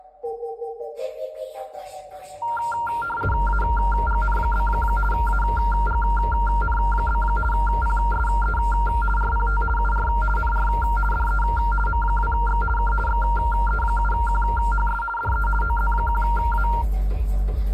RTTY (50 baud, 450 Hz shift), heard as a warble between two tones, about 1160 Hz centre. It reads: AGN? AGN? PSE RPT UR NR DE M2X K XE7QHS DE OZ1A